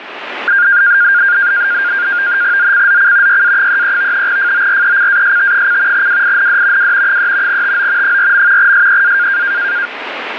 NAVTEX (SITOR-B), 100 baud, 170 Hz shift, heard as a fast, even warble, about 1500 Hz centre, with radio static. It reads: ZCZC YA33 FORECAST: WIND W 3 TO 4. SEA